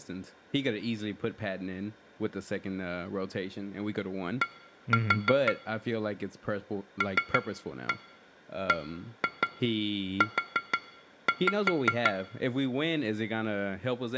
Tap code, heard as taps on glass, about 5 knocks a second, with room echo and speech in English. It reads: D LBU